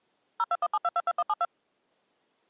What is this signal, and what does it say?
DTMF, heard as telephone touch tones, dialled by machine, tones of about 40 ms. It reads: 0217222172